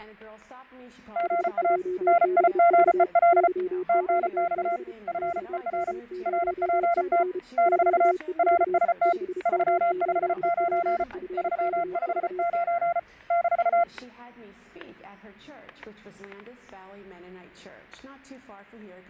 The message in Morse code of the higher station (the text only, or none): GA NIGEL TNX FER RPT - RST 359 359 -